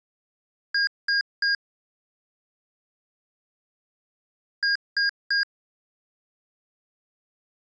Beep code, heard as beeps from a small speaker, played twice, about 1600 Hz. 3 short. In AMI BIOS tables: failure in the first 64 KB of memory; in Dell tables: chipset error.